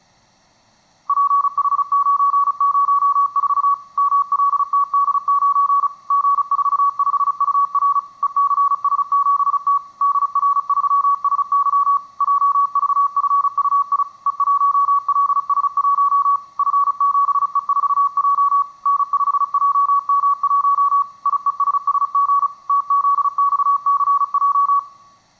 Morse code, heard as a keyed tone, machine-sent, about 35 wpm, 1130 Hz, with room echo. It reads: PH904 MLTD9 G45UR ECS7T DR3SY JVFUI E1LS1 F7E4J N5JM1 IESSG TZXCJ